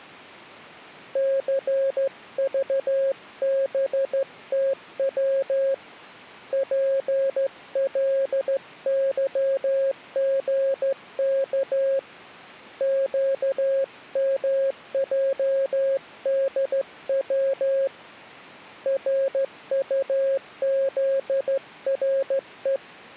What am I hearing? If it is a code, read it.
Morse code, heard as a keyed tone, hand-sent with a straight key, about 14 wpm, 540 Hz. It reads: CVBTW PLYGK QMJDW RUZRE